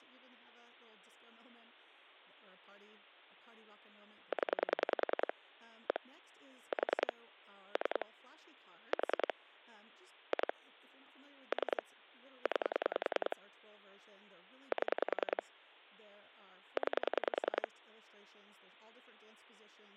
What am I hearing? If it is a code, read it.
Pulse dialling, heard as clicks on a phone line, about 10 pulses a second, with speech in English. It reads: 0 1 4 3 4 2 3 9 7 9